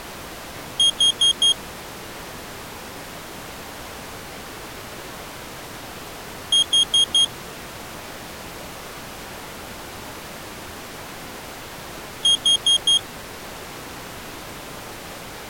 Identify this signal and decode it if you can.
Alarm pattern, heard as an alarm's beeps, played three times, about 3250 Hz. Temporal four. Carbon monoxide.